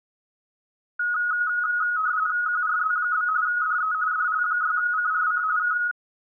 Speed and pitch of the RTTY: 45.45 baud, 170 Hz shift, 1360 Hz centre

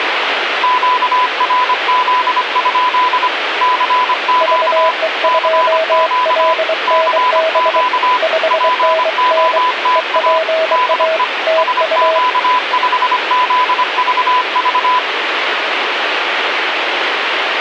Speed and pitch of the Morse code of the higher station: 25 wpm, 1000 Hz

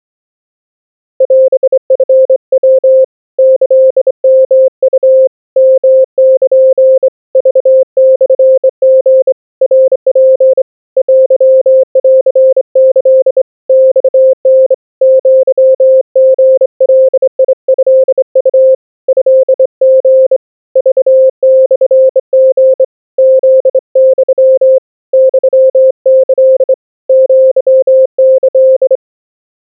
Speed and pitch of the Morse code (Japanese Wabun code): 25 wpm, 520 Hz

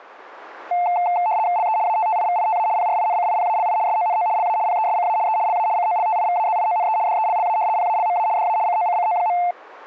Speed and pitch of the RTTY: 75 baud, 170 Hz shift, 790 Hz centre

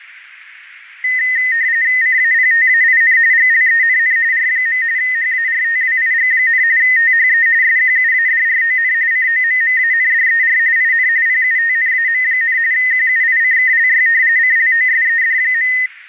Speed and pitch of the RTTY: 45.45 baud, 170 Hz shift, 1950 Hz centre

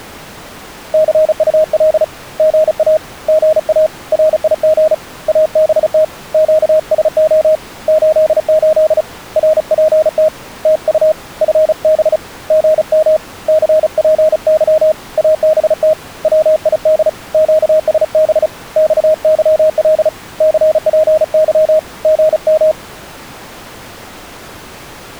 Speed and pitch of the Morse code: 35 wpm, 620 Hz

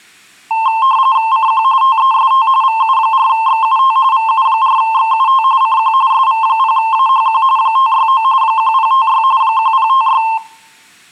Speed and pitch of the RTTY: 45.45 baud, 170 Hz shift, 980 Hz centre

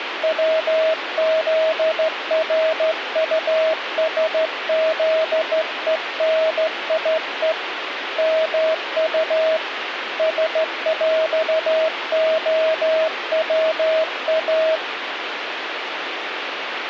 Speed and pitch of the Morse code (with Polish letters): 14 wpm, 640 Hz

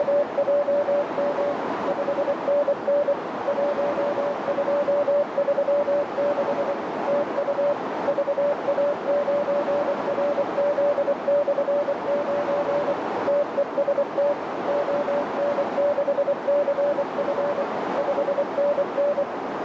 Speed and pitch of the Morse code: 24 wpm, 580 Hz

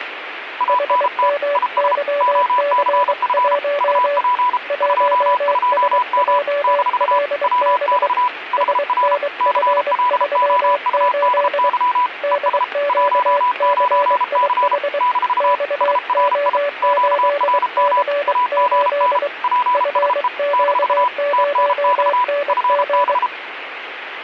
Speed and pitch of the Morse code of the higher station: 33 wpm, 990 Hz

